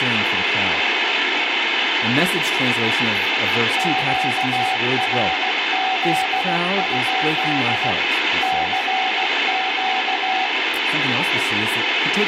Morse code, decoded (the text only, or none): QRZ? CQ